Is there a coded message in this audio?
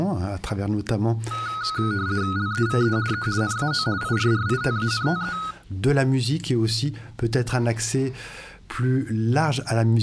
Yes: RTTY (50 baud, 170 Hz shift) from 1.3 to 5.5 s, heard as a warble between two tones, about 1360 Hz centre. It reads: LEVE E NAO IRRITANTE